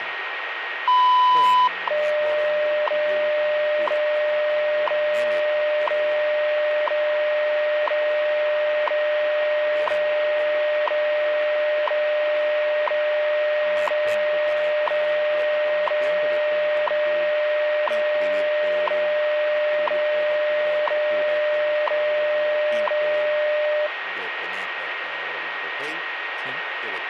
Radio time signal (WWV, Colorado), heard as ticks, one a second, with radio static and a steady whistle near 1870 Hz.